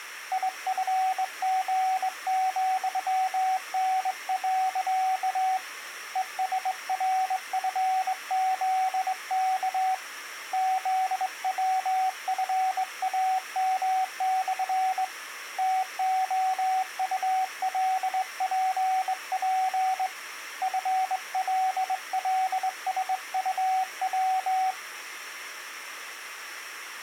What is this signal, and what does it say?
Morse code, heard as a keyed tone, hand-sent with a straight key, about 21 wpm, 750 Hz. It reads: IFG,N. ESRFZK ZWFAM/ TOULPP FLLSUW